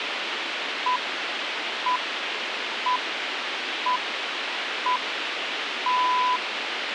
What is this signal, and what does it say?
Radio time signal (six pips, as the Greenwich Time Signal), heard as pips, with radio hiss and a squelch burst at the end.